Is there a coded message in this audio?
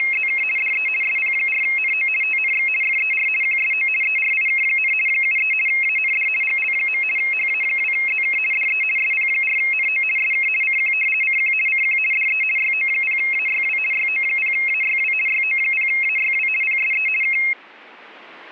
Yes: RTTY (50 baud, 450 Hz shift) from 0.0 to 17.5 s, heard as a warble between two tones, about 2350 Hz centre. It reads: … DE SP4NO TNX FER QSO ERIK, 73 AND GL. HA2ZK DE SP4NO SK CQ CQ CQ DE YO0AYW YO0AYW YO0AYW PSE K